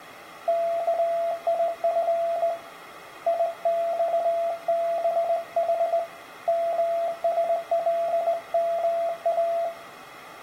Morse code (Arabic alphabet), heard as a keyed tone, hand-sent with a straight key, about 19 wpm, 680 Hz, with room echo. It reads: كيف يصبح مسلما